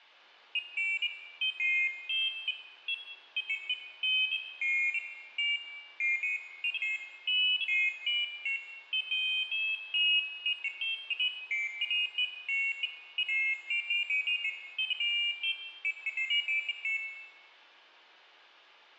Pairs of high tones at irregular times, with room echo. There is no code.